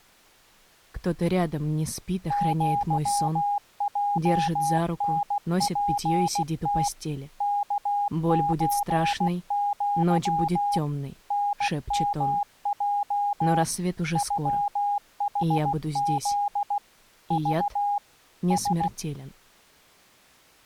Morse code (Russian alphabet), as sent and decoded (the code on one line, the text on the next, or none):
--.-- .--- -. .--. - / -.- ---. --.-- / -. -- .--- / ..-- .... --.. / ...- / ...
ЪЙНПТ КЧЪ НМЙ ЮХЗ Ж С